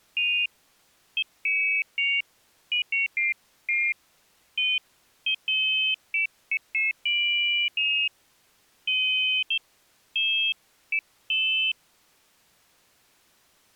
Pairs of high tones at irregular times. There is no code.